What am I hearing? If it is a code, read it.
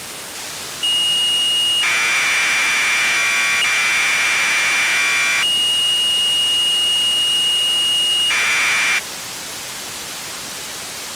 Commodore tape loading (standard loader), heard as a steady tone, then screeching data, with tape hiss.